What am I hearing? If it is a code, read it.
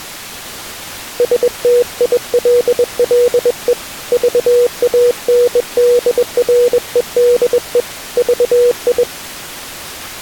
Morse code, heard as a keyed tone, hand-sent with a bug key, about 21 wpm, 480 Hz. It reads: STILLE VANDREDE VI